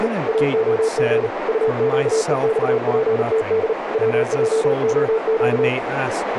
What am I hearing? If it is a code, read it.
Morse code, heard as a keyed tone, machine-sent, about 38 wpm, 440 Hz, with radio static, a narrow filter and speech in English. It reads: … AOG UQEXPTD WJOQ